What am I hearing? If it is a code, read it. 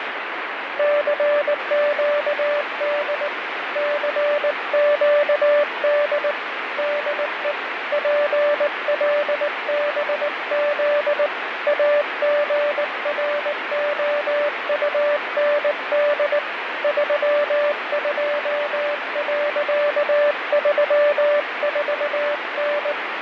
Morse code, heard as a keyed tone, hand-sent with a paddle, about 19 wpm, 590 Hz, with radio static. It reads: CQD CQD DE PLBZ AGROUND 32.34N